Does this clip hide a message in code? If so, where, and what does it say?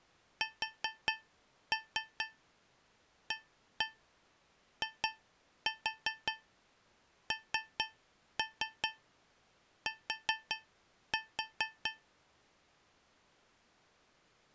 Yes: tap code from 0.4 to 12.1 s, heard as taps on a metal pipe, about 4 knocks a second. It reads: SAINT